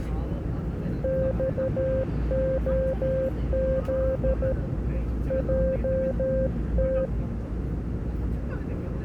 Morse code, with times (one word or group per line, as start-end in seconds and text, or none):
1.0-4.5 XOZ
5.3-7.1 JT